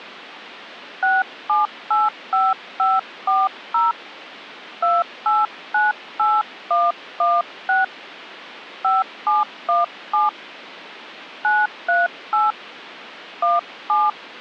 DTMF, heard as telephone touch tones, dialled by hand, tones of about 190 ms. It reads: 6785540 2898116 5717 938 17